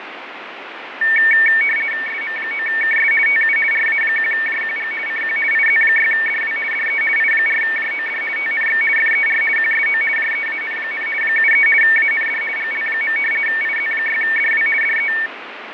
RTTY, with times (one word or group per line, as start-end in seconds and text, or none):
2.1-3.1 SM9KS
3.3-3.6 TU
3.7-4.9 RA1JQG
5.1-5.4 CQ
5.5-6.6 IZ6DW
6.7-7.0 DE
7.2-8.2 I4JOD
8.4-8.8 TNX
9.0-9.4 FER
9.6-10.0 QSO
10.2-11.1 JEAN,
11.2-11.7 73
11.8-12.4 AND
12.6-13.2 GL.
13.5-14.7 IZ6DW
14.8-15.1 DE